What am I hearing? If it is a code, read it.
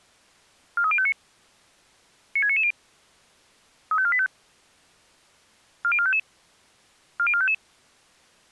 Five-tone selective call (ZVEI), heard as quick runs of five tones, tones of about 70 ms. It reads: 43059 96990 35485 40455 40455